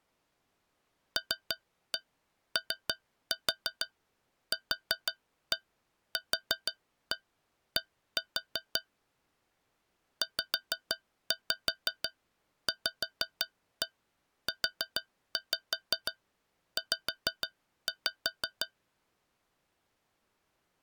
Tap code, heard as taps on a metal pipe, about 6 knocks a second. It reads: LOQQD ZVUZ